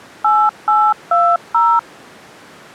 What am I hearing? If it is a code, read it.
DTMF, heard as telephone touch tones, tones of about 250 ms. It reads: 8820